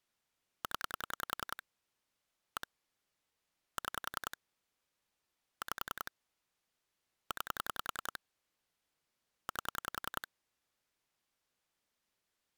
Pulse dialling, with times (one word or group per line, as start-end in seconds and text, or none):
0.6-1.6 0
2.6-2.7 1
3.8-4.4 6
5.6-6.1 5
7.3-8.2 9
9.5-10.3 8